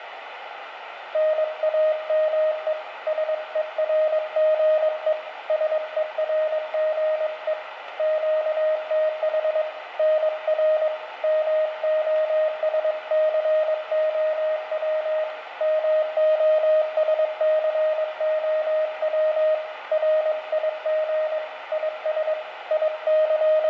Morse code, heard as a keyed tone, hand-sent with a paddle, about 22 wpm, 620 Hz, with radio static and room echo. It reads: NAME SERGE SERGE QTH NR MOSCOW MOSCOW RIG IS …